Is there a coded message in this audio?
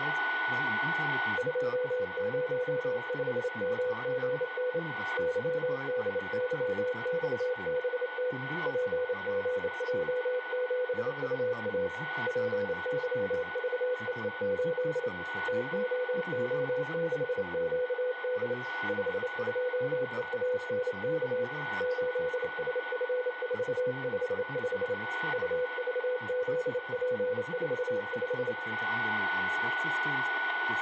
Yes: Morse code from 1.3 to 28.6 s, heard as a keyed tone, hand-sent with a straight key, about 28 wpm, 500 Hz, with a steady whistle near 1480 Hz, room echo and speech in German. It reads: 205MGN YDYXBT PGJ7UA PYVEE8 TOO6QD 52EANK 8SF455 UVZP45